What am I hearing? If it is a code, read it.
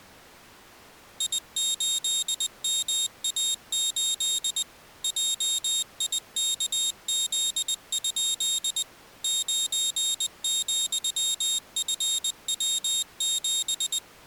Morse code, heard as a high beeper, machine-sent, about 20 wpm, 3700 Hz. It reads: I8MA8 JIKZ? 9,FW7